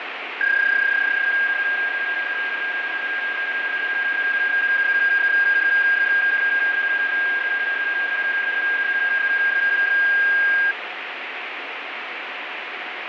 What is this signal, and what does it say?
PSK31 (31.25 baud), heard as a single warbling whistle, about 1600 Hz, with radio static and fading.